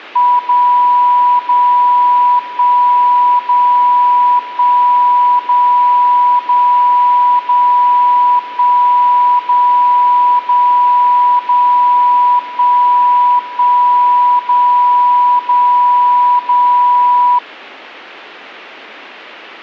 Radio time signal (DCF77), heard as a tone whose level steps once a second, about 980 Hz. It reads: 0 0 1 0 1 0 0 0 1 0 0 0 1 1 0 0 0